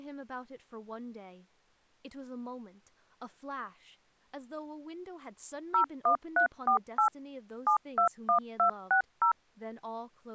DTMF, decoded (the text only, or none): 01348 721260